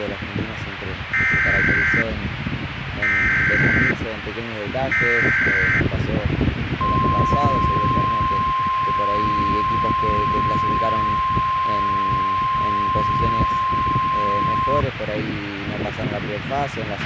Emergency Alert System (SAME) tones (header bursts, then the 1050 Hz attention tone), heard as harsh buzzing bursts, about 520.83 baud, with radio hiss and a squelch burst at the end.